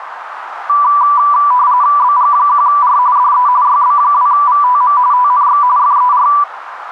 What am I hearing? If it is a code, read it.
RTTY (45.45 baud, 170 Hz shift), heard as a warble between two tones, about 1080 Hz centre, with radio static. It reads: BG1R DE YB2VTM TNX FER